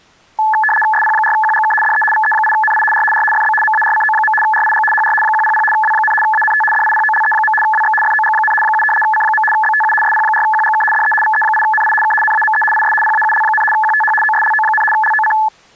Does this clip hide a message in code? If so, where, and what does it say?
Yes: RTTY (75 baud, 850 Hz shift) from 0.4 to 15.5 s, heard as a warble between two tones, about 1290 Hz centre. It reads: SP4QGK DE VE8NI R R FB MARCO. RIG HR 100 W, ANT DIPOLE. WX FOG, 7 C. BTU SP4QGK DE VE8NI K NAME IS PAUL, QTH OSLO, LOC